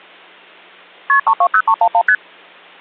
Multi-frequency trunk signalling (R1, as on North American trunks), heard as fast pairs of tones, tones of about 70 ms. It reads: KP 320311 ST